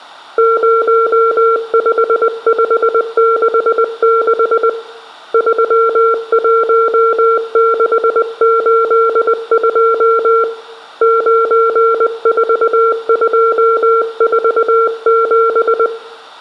Morse code, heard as a keyed tone, hand-sent with a paddle, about 20 wpm, 460 Hz, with room echo. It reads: 05566 31682 94247